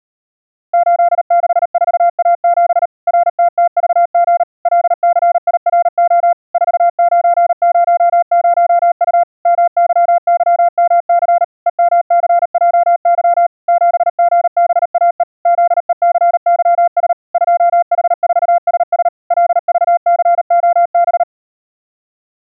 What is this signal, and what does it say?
Morse code, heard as a keyed tone, machine-sent, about 38 wpm, 690 Hz. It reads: 864A7 RTTVG LCIRO 4900U MYYMC EMCJY 7GBAE ZECYS 2H4SS LVCOB